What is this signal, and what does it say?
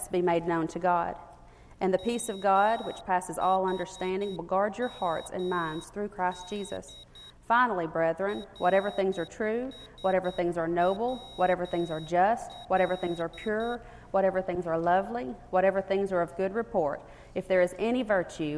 Morse code (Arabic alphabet), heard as a high beeper, hand-sent with a paddle, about 9 wpm, 3800 Hz. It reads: محمد رسول